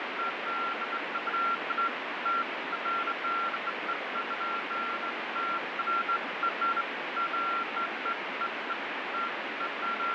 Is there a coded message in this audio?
No, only beeps of irregular length, with heavy radio static and fading.